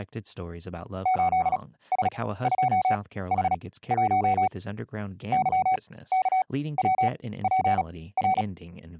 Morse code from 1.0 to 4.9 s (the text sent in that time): 8S2H1